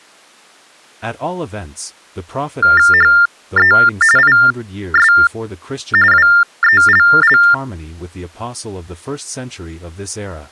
TTY/TDD text telephone tones (45.45 baud Baudot), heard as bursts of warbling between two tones, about 400 Hz shift, 1600 Hz centre, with speech in English. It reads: HE IS WELL